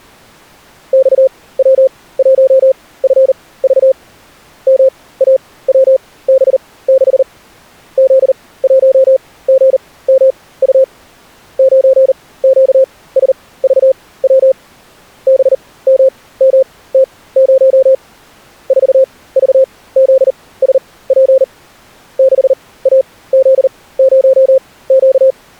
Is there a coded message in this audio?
Yes: Morse code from 0.9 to 25.4 s, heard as a keyed tone, machine-sent, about 39 wpm, spaced as for 20 wpm, 530 Hz. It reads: XW1FV MAWB6 Z1GMU 9QSVW BMMT0 4VZSP 6AZ0Q